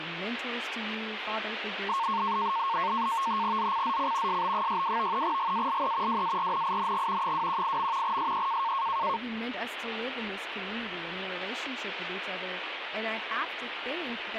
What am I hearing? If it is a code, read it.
NAVTEX (SITOR-B), 100 baud, 170 Hz shift, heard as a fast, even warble, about 1000 Hz centre, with radio static and speech in English. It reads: ZCZC SB62 GALE WARNING 218. SE